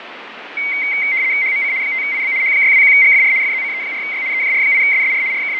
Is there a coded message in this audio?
Yes: RTTY (75 baud, 170 Hz shift) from 0.6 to 5.6 s, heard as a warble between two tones, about 2150 Hz centre, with radio static and fading. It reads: HMC 5IB H621GFR FZCE4Y EJR8SSR …